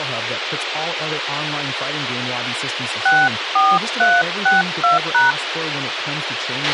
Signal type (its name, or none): DTMF